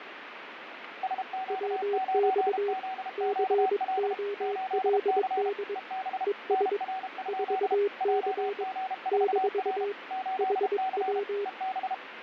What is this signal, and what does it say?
Morse code, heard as two keyed tones, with radio static. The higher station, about 32 wpm, 760 Hz: SQ9ZQL 8C EB NR? JG4R 8C EB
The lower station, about 22 wpm, 410 Hz: WX COLD ES 4C - HW